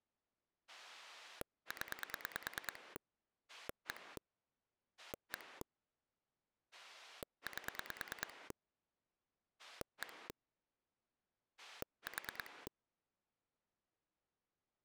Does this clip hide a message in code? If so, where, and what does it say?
Yes: pulse dialling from 0.7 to 12.7 s, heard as a rotary dial, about 9 pulses a second. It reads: 0 1 1 8 1 4